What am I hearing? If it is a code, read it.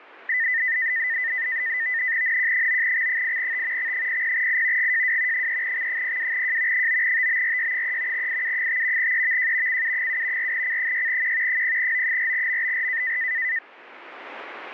NAVTEX (SITOR-B), 100 baud, 170 Hz shift, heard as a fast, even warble, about 1900 Hz centre. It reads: NQ9X8T X00I GJW 3X02J 9TBRY3 IU5 EVJ CU7 4C6Q 0O4MBR